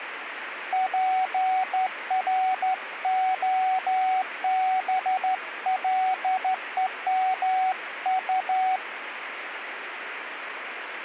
Morse code (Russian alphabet), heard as a keyed tone, hand-sent with a straight key, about 13 wpm, 750 Hz, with radio static. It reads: ПРОБЛЕМУ